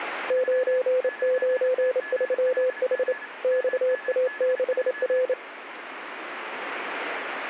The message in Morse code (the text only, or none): 993H XA6R